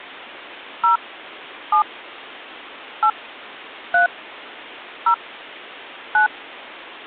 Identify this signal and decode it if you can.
DTMF, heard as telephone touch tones, dialled by hand, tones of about 110 ms. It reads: 0 7 8 3 0 9